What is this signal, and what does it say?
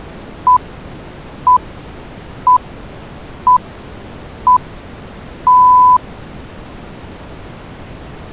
Radio time signal (six pips, as the Greenwich Time Signal), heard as pips.